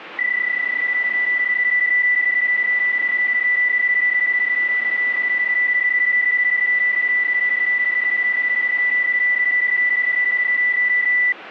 PSK31 (31.25 baud), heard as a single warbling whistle, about 2000 Hz, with radio static.